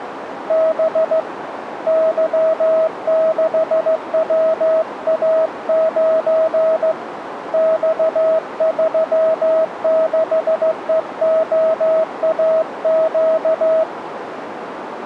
Morse code, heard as a keyed tone, hand-sent with a straight key, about 15 wpm, 640 Hz, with radio static and a narrow filter. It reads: B Y6WA9 X36EOAQ